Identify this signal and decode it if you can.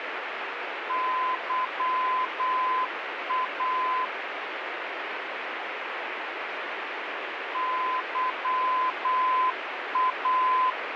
Morse code, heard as a keyed tone, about 8 wpm, 1020 Hz, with radio static. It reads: YA YA